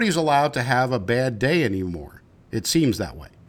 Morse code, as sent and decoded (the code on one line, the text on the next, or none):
none